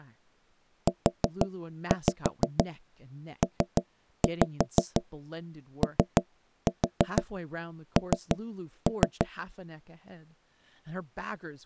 Tap code, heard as knocks on wood, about 6 knocks a second, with speech in English. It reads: UPON